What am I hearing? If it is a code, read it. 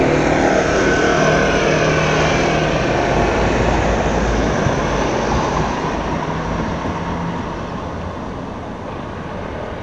Street noise. There is no code.